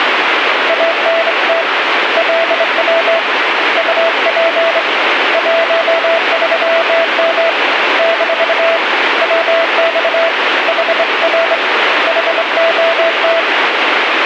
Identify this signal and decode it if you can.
Morse code, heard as a keyed tone, hand-sent with a straight key, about 24 wpm, 660 Hz, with radio static. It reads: ANT LW UP 13M - WX HR HOT